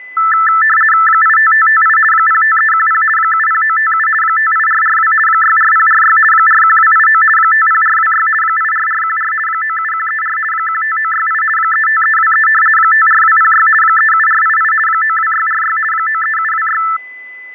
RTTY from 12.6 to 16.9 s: 54206 37488 92646 93726

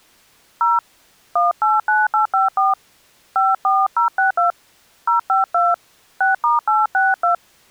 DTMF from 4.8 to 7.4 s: 052 6*862

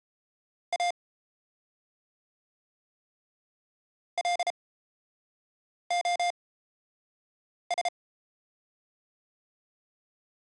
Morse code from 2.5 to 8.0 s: LOS

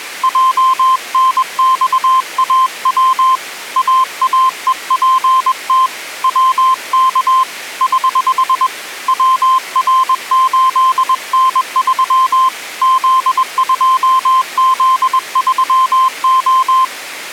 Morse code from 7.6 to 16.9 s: <HH> WR8N3 Z2Z3O

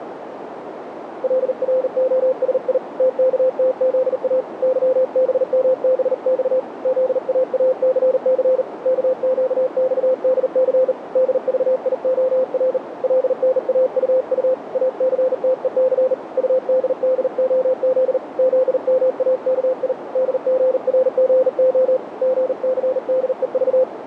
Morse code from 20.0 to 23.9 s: DGRGO GCDEV

